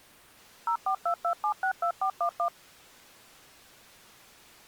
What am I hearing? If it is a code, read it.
DTMF, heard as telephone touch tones, dialled by machine, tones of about 90 ms. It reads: 0422762411